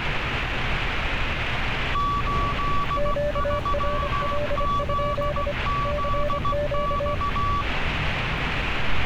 Morse code, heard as two keyed tones, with radio static and street noise. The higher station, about 16 wpm, 1140 Hz: 83ZZX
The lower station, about 25 wpm, 590 Hz: QRL? CQ